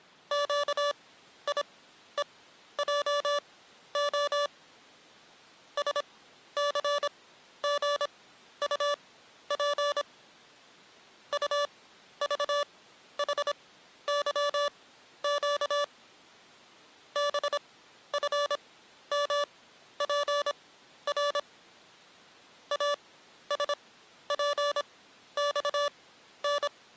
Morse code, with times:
0.3-4.5 QIEJO
5.8-10.0 SCGUP
11.3-15.8 UVHYQ
17.2-21.4 BFMPR
22.7-26.7 ASPXN

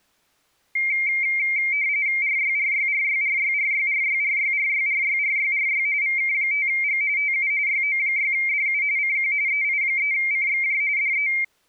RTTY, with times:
2.2-5.9 RYRYRYRYRYRYRYRYRYRYRY
6.0-7.0 VK5G
7.2-7.5 TU
7.7-8.8 YO6DU
9.0-9.3 CQ
9.5-10.8 EI3CXJ
11.0-11.3 DE

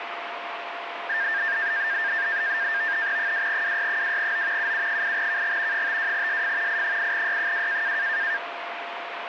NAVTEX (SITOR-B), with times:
3.2-4.7 2WY2O
4.6-5.9 UU8KG
5.7-6.8 52SF
6.7-8.0 I8Y2

